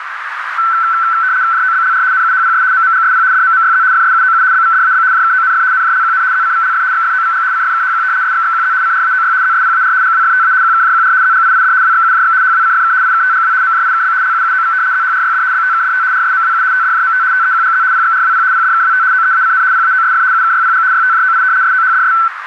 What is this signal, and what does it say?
RTTY (75 baud, 170 Hz shift), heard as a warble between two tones, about 1430 Hz centre, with radio static and a narrow filter. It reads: JOBLR NUHPS MMGSP DMMYZ FSUOU BVDAB JKONF NJLQN ZCVLF XFOVG CFKHQ SXXQZ CRAOY ZSPAR GWFTA QKJQR ZGIID WXUJX HWCFK IKTGW MJIKB LUUOV ZHRYD BTKDT RSMWU TDJMT TEQGZ PXRWP PDKWT OEACN PAOSF UKYPG YTJOI SOHDS